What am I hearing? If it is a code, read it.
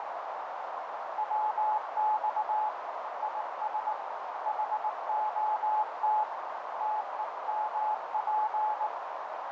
Morse code, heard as a keyed tone, hand-sent with a paddle, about 19 wpm, 860 Hz, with heavy radio static and a narrow filter. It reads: WX IS HOT TEMP